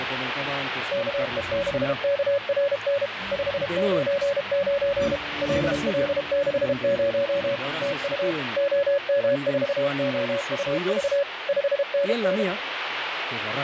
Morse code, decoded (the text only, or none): KE6KRN 599 LL60 TU OM4OUV 5NN